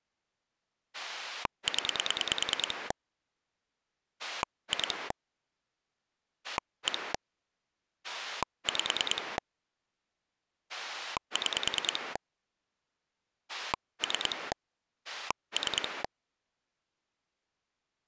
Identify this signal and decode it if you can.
Pulse dialling, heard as a rotary dial, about 9 pulses a second. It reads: 0 2 1 5 6 3 3